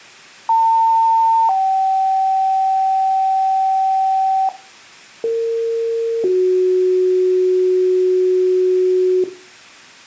Two-tone page, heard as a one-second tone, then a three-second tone, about 900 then 770 Hz, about 460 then 370 Hz.